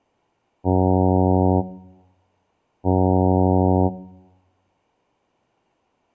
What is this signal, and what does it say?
Ship horn signal, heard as a ship's horn, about 90 Hz. 2 short. At sea: I am altering course to port.